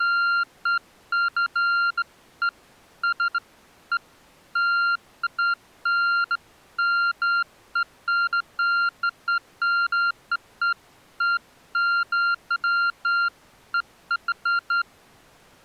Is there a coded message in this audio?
No, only beeps of irregular length.